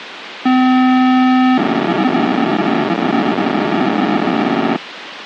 POCSAG pager data (512 baud), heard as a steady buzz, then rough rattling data, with radio hiss.